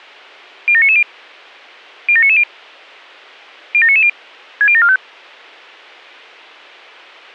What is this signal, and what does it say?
Five-tone selective call (ZVEI), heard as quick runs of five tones, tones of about 70 ms. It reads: 07990 07990 07990 60745